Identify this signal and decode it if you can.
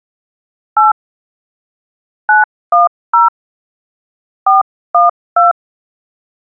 DTMF, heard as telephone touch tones, dialled by hand, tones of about 150 ms. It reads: 8 910 412